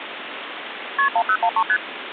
Multi-frequency trunk signalling (R1, as on North American trunks), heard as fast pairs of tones, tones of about 70 ms, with phone line noise. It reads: KP 1013 ST